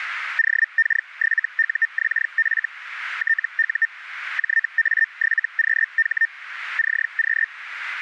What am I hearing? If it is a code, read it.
Hellschreiber (Feld-Hell, 122.5 baud), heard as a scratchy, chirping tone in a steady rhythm, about 1800 Hz, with radio static. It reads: OK7UXF TU JA7QH CQ